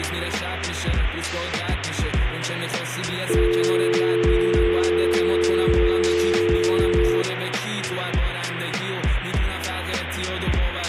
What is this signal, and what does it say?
Telephone call progress tone (North American or UK plan), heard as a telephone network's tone, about 350, 440 Hz, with phone line noise. Dial tone.